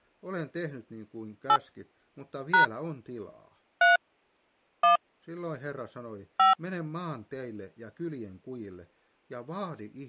DTMF, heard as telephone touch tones, dialled by hand, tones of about 110 ms. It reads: 8 # 3 1 5